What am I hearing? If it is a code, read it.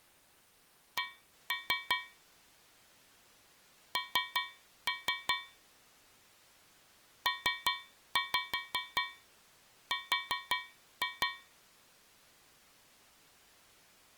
Tap code, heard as taps on a metal pipe, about 5 knocks a second. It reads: C N PR